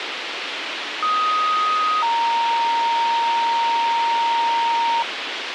Two-tone page, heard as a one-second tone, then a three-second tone, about 1250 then 930 Hz, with radio hiss and a squelch burst at the end.